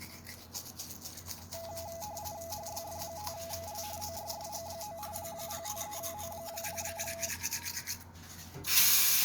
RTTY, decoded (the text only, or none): HYF5L OYSG9 053O0